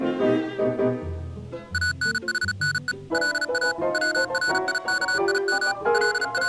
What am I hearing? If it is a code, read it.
Morse code (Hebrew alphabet), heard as electronic beeps, machine-sent, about 36 wpm, 1480 Hz. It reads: אנחנו לא צריכים …